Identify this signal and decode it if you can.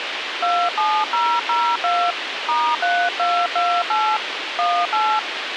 DTMF, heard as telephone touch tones, dialled by hand, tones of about 260 ms, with radio hiss. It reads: 27002 *3228 18